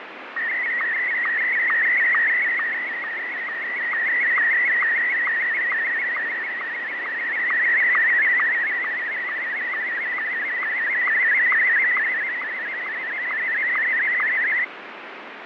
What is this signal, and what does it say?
SSTV (slow-scan television), Martin M1, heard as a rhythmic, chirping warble, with radio static and fading.